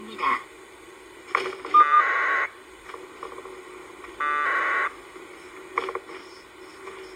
Packet radio (AX.25, as in APRS), 1200 baud, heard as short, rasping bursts.